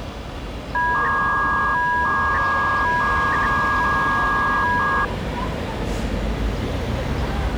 300-baud modem data (V.21 tones), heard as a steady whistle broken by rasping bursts, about 300 baud, 200 Hz shift, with the noise of a residential street.